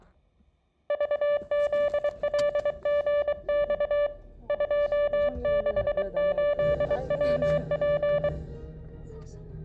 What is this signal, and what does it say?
Morse code, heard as a keyed tone, hand-sent with a paddle, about 23 wpm, 580 Hz, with room echo and the noise inside a car. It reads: VZLGX 268WP